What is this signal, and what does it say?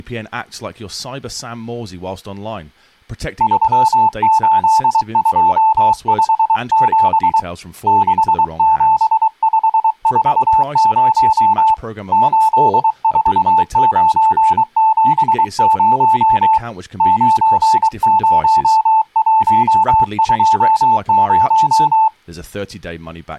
Morse code, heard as a keyed tone, hand-sent with a paddle, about 23 wpm, 880 Hz, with speech in English. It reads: 38257 67540 84970 90120